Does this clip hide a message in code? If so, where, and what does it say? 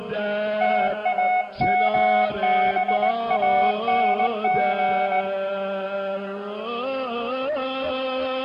Yes: Morse code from 0.6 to 5.3 s, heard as a keyed tone, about 18 wpm, 740 Hz, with room echo. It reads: TAMBANG